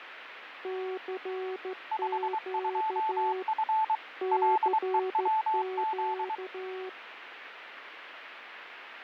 Morse code, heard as two keyed tones, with radio static and fading. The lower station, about 14 wpm, 370 Hz: CQ CQ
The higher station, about 23 wpm, 880 Hz: 52F LEWZ